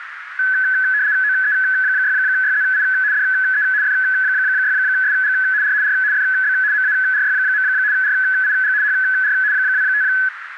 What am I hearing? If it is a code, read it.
RTTY (75 baud, 170 Hz shift), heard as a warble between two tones, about 1600 Hz centre, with radio static and a narrow filter. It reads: OE6YZI DE F6SG R R FB MARY. RIG HR 25